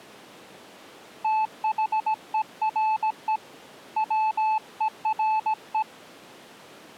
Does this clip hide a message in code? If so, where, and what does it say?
Yes: Morse code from 1.2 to 5.9 s, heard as a keyed tone, hand-sent with a paddle, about 17 wpm, 870 Hz. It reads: THERE WERE